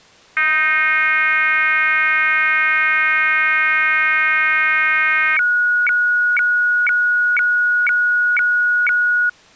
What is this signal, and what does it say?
Weather fax (radiofax), 120 lines a minute, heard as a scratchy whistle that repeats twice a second.